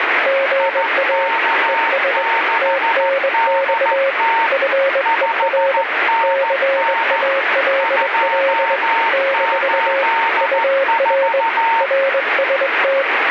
Morse code, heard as two keyed tones, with radio static. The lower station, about 21 wpm, 540 Hz: GA ES TNX FER CALL - UR RST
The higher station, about 14 wpm, 910 Hz: IK6DT 5NN 284